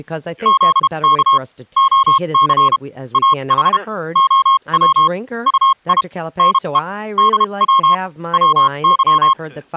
Morse code, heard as a keyed tone, machine-sent, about 32 wpm, spaced as for 27 wpm, 1080 Hz, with speech in English. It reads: ZK OC AH OW UI NE DW WY